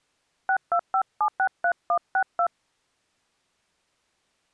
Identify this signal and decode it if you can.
DTMF, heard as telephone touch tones, dialled by hand, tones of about 80 ms. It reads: 625763162